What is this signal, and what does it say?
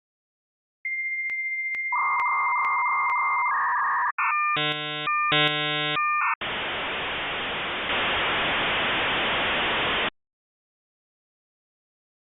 Dial-up modem handshake (V.34 or later), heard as a whistle, warbles, then hiss.